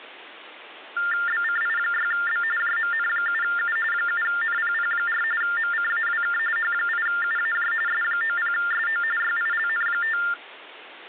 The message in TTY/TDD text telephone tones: BCI6B JMN7U 7NPP4 MCAWK H8UAJ S90SO YILN5

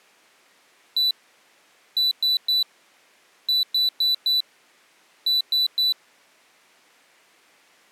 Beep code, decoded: 1-3-4-3

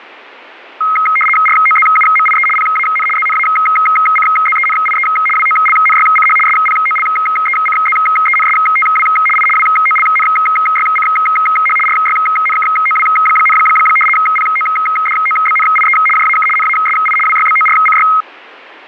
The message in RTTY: ROZUMIE PAN ZNACZENIE WOLNYCH SPOLECZENSTW I WOLNYCH RYNKOW, PODOBNIE JAK NASI WYBORCY

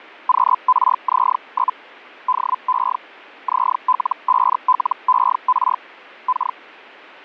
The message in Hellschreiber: QRZ? DE ZL5LER K

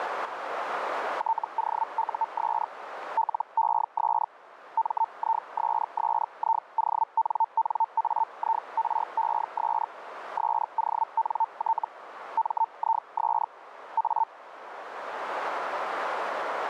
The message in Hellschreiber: TOUS LES MISSIONNAIRES SONT MIS A

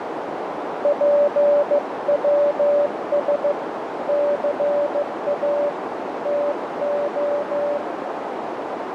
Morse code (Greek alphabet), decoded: ΠΩΣ ΘΑ ΤΟ

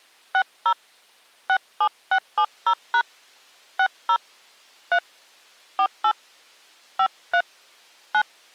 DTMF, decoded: 60 67670# 60 3 48 53 9

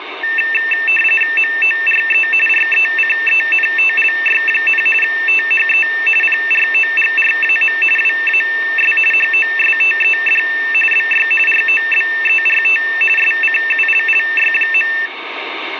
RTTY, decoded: MORE RECENTLY, THE PROGRAM WAS HOSTED BY ROBERT SCULLY.

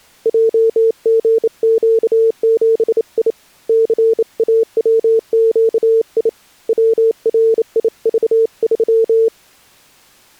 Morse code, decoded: JGQ7I CAWQI WRIV3

